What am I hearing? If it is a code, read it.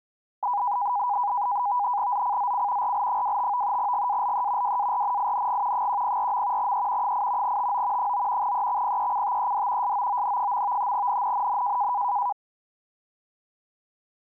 NAVTEX (SITOR-B), 100 baud, 170 Hz shift, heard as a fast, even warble, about 900 Hz centre. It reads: ZCZC RL25 GALE WARNING 104. E 8 TO 9 EXPECTED SOON. NNNN